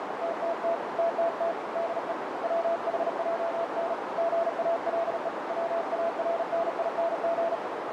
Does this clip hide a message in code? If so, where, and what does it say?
Yes: Morse code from 0.2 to 7.6 s, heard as a keyed tone, hand-sent with a paddle, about 37 wpm, 670 Hz, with heavy radio static and a narrow filter. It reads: TTT TTT DE WHJN GALE WARNING